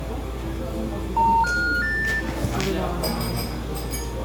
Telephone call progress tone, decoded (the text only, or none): special information tone